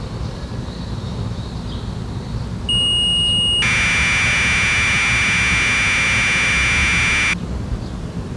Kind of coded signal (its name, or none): Commodore tape loading